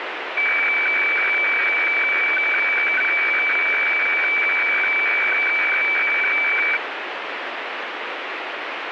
Weather fax (radiofax), 120 lines a minute, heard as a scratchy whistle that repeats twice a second, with radio static.